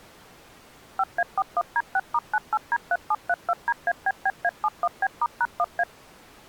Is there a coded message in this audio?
Yes: DTMF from 1.0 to 5.8 s, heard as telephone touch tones, dialled by machine, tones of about 50 ms. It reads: 5A41D6*98D3732DABBA71B*#1A